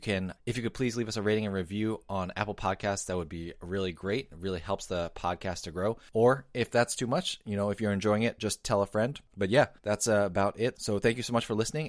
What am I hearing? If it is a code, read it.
Speech in English. There is no code.